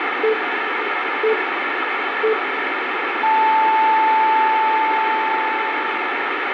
Radio time signal (three low pips and a long one an octave up, as on NHK), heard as pips, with radio static.